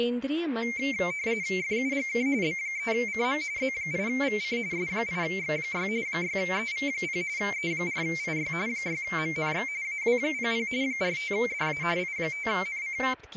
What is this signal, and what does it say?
RTTY (45.45 baud, 170 Hz shift), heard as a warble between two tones, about 2200 Hz centre, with speech in Hindi. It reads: FUGK B3CM Z8VC S8X6 6EV0 E4IY 6MNX AW00 45DA I5NC